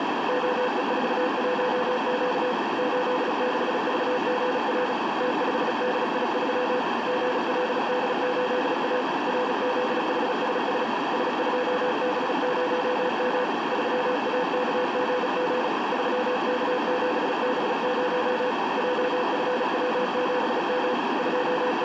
Morse code, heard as a keyed tone, hand-sent with a paddle, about 36 wpm, 500 Hz, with heavy radio static and a narrow filter. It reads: OE41Q 86VGR T5DI3 GLD8A RZHSS S2B0M 3AKGG 3K7B0 JFW7M …